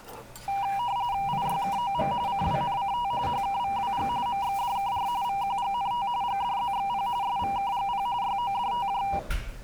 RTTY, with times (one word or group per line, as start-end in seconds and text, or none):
1.3-2.1 IYKOM
2.3-3.1 CWNCT
3.3-4.1 HKVWG
4.3-5.1 MXDKR
5.2-6.1 VQGNT
6.2-7.1 GDZXP
7.2-8.1 SVKGP
8.2-9.0 YODTJ